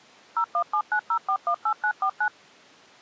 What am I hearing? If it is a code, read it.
DTMF, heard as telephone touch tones, dialled by machine, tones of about 80 ms. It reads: 01790418949